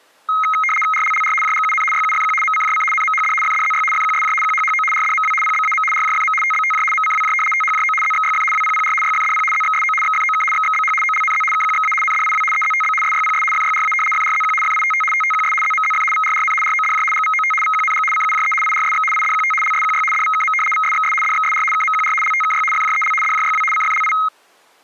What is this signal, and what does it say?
RTTY (75 baud, 850 Hz shift), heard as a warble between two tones, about 1700 Hz centre. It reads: RLLR JGUN YUFQ MCJC NMHD FDZY FQSJ QHHO RDMW PBAM RJFM TBTJ MCWJ THJO ZXYF WPPR YFDP ZXSO XFOK XXBH OLNZ KQXA NDIW EZTB SYPS FYRA FRZQ FITT TTQS ZMZF VRRN RODJ GVOT VQNG CUJE IRSX IDQT LSQY DVKM VSXS DXSR KMQR LTKY FJEL DJYW CFLI